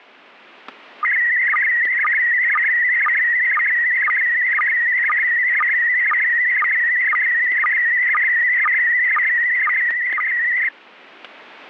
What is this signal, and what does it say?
SSTV (slow-scan television), PD 120, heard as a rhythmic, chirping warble, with static crashes.